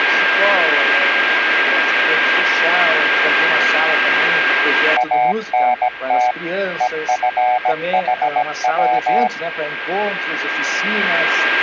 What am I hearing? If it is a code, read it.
Morse code, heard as a keyed tone, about 17 wpm, 740 Hz, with radio static and a steady whistle near 1600 Hz. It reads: ANT EFHW